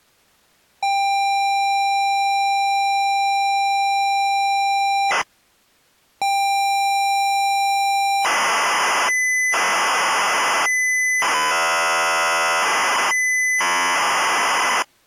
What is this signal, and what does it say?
ZX Spectrum tape loading, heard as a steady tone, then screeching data.